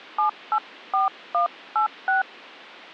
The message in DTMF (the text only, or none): 784186